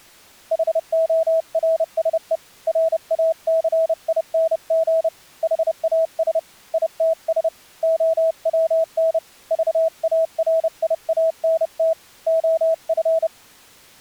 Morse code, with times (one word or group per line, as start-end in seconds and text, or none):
0.5-2.4 HORSE
2.7-5.1 RACING
5.4-6.4 HAS
6.7-7.5 ITS
7.8-9.2 OWN
9.5-11.9 VARIANT
12.3-13.3 OF